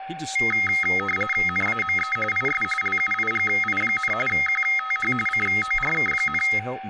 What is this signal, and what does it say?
RTTY (45.45 baud, 850 Hz shift), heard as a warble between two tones, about 1700 Hz centre, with a steady whistle near 770 Hz and speech in English. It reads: NAME IS LUIGI, QTH CORK,